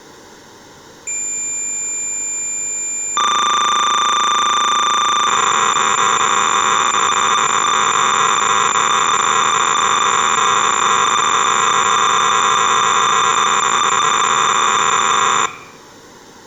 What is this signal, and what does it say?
Cassette data (Kansas City type), 300 baud, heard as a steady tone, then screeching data.